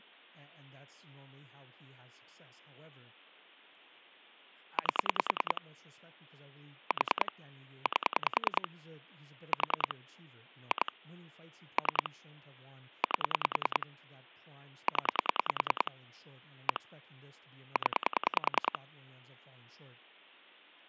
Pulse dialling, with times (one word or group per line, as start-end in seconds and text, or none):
4.8-5.6 8
6.9-7.3 4
7.9-8.7 8
9.5-9.9 4
10.7-10.9 2
11.8-12.1 3
13.0-13.9 8
14.9-15.9 0
16.7-16.8 1
17.8-18.8 0